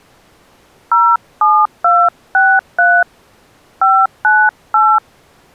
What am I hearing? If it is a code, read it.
DTMF, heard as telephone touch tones, dialled by hand, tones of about 240 ms. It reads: 07263 598